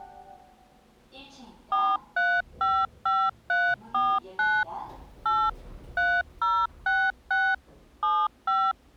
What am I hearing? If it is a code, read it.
DTMF, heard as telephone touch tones, dialled by machine, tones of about 240 ms, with the noise inside a lift. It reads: 4355349 8 3066 75